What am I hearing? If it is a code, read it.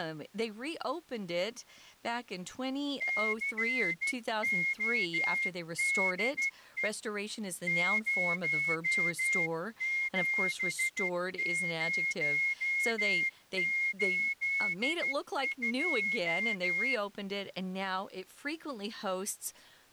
Morse code, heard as a whistle, hand-sent with a straight key, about 13 wpm, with speech in English. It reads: CODE 07082